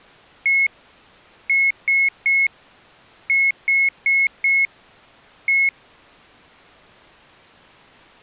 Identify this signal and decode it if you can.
Beep code, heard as beeps from a small speaker, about 2200 Hz. 1-3-4-1. In Phoenix BIOS tables: memory failure on an address line.